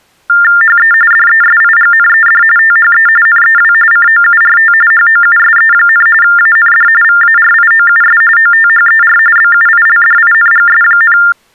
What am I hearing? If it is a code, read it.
TTY/TDD text telephone tones (45.45 baud Baudot), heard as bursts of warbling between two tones, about 400 Hz shift, 1600 Hz centre. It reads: HE DESIGNED THE NEW COURT HOUSE, AND VARIOUS OTHER BUILDINGS,